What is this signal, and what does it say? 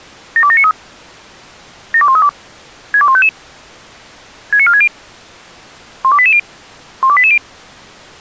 Five-tone selective call (ZVEI), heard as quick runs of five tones, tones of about 70 ms. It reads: 72793 72132 62155 69460 12880 12880